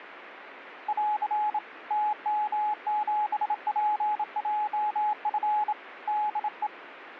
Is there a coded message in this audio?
Yes: Morse code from 0.8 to 6.7 s, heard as a keyed tone, hand-sent with a bug key, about 27 wpm, 840 Hz, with radio static. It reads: <AR> TM7PJF DE